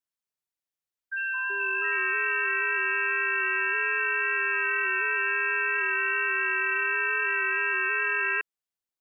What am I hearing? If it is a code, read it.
FT8 (several signals at once), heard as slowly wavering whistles, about 6.25 baud.